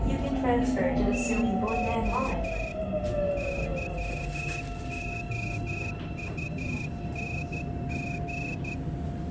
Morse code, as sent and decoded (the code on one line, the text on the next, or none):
- --- / -.-- --- ..- -. --.
TO YOUNG